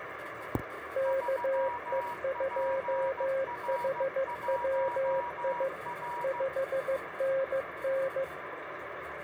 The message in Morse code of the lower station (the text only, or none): KE2HWI 5NN